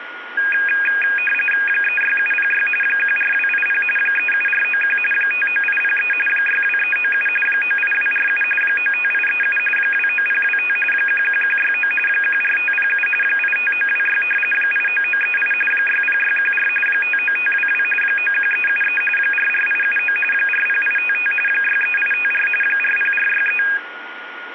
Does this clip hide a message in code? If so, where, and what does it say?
Yes: RTTY (45.45 baud, 850 Hz shift) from 0.4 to 23.8 s, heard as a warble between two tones, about 2050 Hz centre, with radio static and a steady whistle near 1440 Hz. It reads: 36706 14280 37491 59803 62397 98247 95837 29025 11169 14507 85926 89938 60614 59522 91373 44879 40855 63854 40463